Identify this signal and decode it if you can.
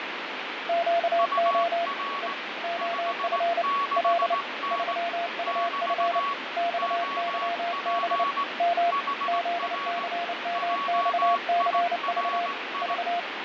Morse code, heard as two keyed tones, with radio static and fading. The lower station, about 29 wpm, 690 Hz: QO E OF L 3UF XYB M ZCMXCV V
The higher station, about 18 wpm, 1120 Hz: UR 56N <BT> OP HR JIRI